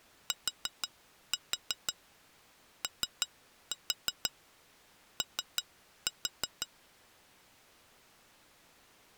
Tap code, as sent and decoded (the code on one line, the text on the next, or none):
4-4 3-4 3-4
TOO